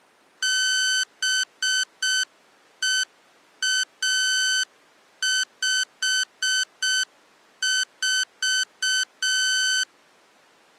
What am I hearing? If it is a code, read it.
Morse code, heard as electronic beeps, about 6 wpm, 1500 Hz. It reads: BEA54